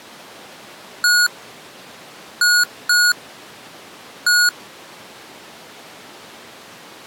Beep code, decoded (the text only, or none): 1-2-1